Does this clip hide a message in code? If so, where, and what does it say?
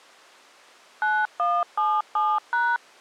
Yes: DTMF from 1.0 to 2.8 s, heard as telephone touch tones, dialled by machine, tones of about 230 ms. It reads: 9177#